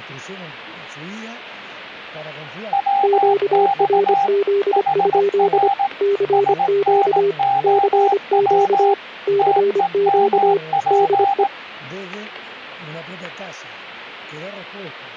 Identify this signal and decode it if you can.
Morse code, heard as two keyed tones, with static crashes. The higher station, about 18 wpm, 800 Hz: WX HR SNOW TEMP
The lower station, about 25 wpm, 400 Hz: QRZ? CQ CQ CQ DE